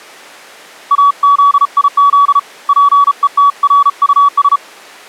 Morse code, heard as a keyed tone, hand-sent with a paddle, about 34 wpm, 1140 Hz. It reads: AZIZ PETRUS